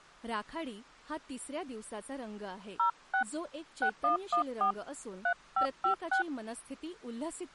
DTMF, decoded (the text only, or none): 06 6114 3556